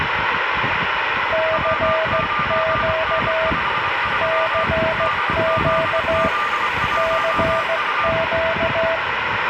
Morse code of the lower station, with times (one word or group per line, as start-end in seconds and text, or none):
1.3-3.5 CQ
4.2-6.3 CQ
7.0-9.0 CQ